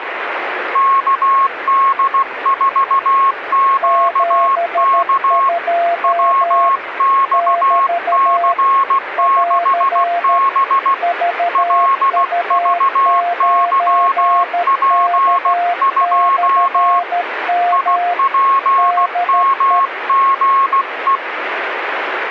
Morse code, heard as two keyed tones, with radio static. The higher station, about 16 wpm, 1090 Hz: KD4QK WXC6B LVYP2 IPMGE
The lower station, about 13 wpm, 700 Hz: 72 <BT> <AR> VU9K/M DE